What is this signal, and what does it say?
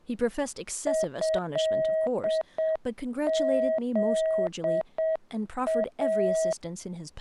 Morse code (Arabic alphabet), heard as a keyed tone, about 7 wpm, 640 Hz, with speech in English. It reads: هذا